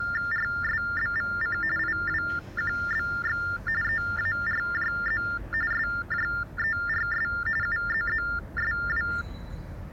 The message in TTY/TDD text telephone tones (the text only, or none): RSBVC IWQBX EARJZ SJERS UZZSW